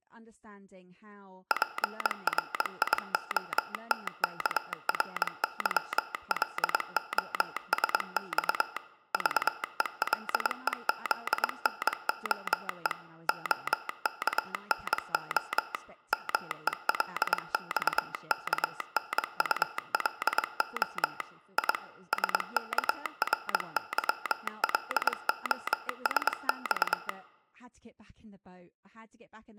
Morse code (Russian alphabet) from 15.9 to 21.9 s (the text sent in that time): МЕЛЬКНУЛО И